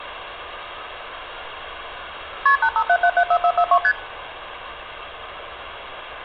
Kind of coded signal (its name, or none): multi-frequency trunk signalling